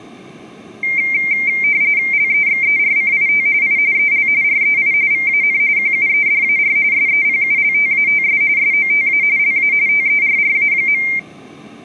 RTTY (45.45 baud, 170 Hz shift), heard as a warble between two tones, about 2200 Hz centre, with room echo. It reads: LEXERCIT I EL REI VAN QUEDAR SEPULTATS SOTA LA TERRA.